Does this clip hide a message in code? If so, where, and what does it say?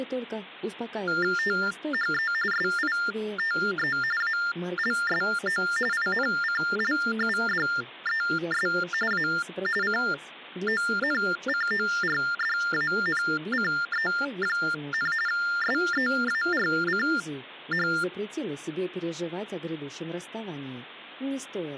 Yes: TTY/TDD text telephone tones (45.45 baud Baudot) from 1.1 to 18.0 s, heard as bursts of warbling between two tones, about 400 Hz shift, 1600 Hz centre. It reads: THE SITE ALSO INCLUDES A CONCORDANCE, SEARCH